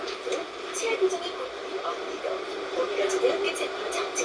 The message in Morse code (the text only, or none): none